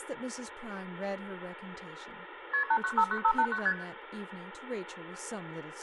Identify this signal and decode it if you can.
Multi-frequency trunk signalling (R1, as on North American trunks), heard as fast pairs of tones, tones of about 70 ms, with room echo and speech in English. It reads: KP 8959589 ST